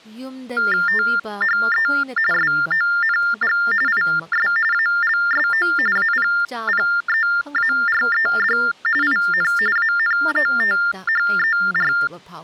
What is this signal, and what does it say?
TTY/TDD text telephone tones (45.45 baud Baudot), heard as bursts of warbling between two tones, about 400 Hz shift, 1600 Hz centre, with speech in Manipuri. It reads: THE SONG IS ALSO APPEARED IN ANOTHER